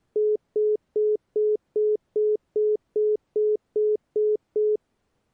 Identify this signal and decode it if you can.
Telephone call progress tone (single-tone plan, as in most of Europe), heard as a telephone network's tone, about 420 Hz, 0.2 s on and 0.2 s off. Congestion tone.